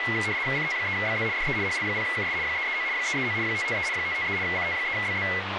RTTY (75 baud, 170 Hz shift), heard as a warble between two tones, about 2050 Hz centre, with radio static and speech in English. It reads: CT3BZ DE HL0KS 339 339 553 553 CT3BZ